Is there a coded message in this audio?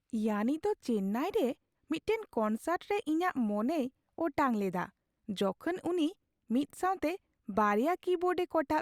No, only speech in Santali.